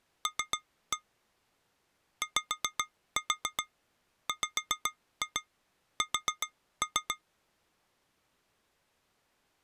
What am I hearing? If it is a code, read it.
Tap code, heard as taps on glass, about 7 knocks a second. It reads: L YWS